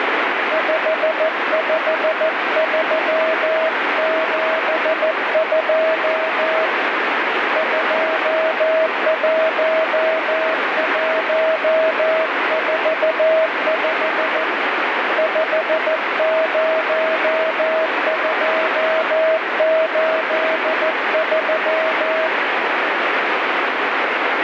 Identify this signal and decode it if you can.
Morse code, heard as a keyed tone, hand-sent with a paddle, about 14 wpm, 640 Hz, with heavy radio static. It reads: 55372 21145 50283